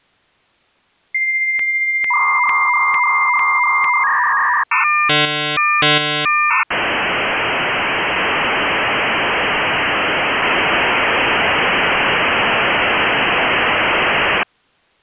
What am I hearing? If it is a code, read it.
Dial-up modem handshake (V.34 or later), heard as a whistle, warbles, then hiss.